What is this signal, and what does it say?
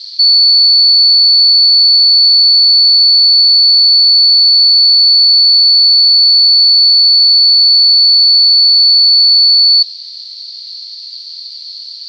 A steady tone, with radio static. There is no code.